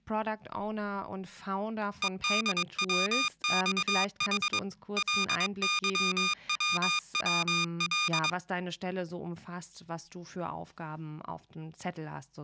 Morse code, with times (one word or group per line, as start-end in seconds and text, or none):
2.0-4.6 EDWXH
5.0-8.3 LYWWL